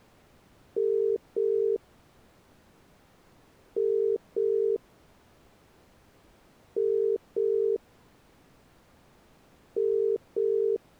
Telephone call progress tone (as in the UK, Ireland, Australia and similar networks), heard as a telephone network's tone, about 400, 450 Hz. Ringback tone.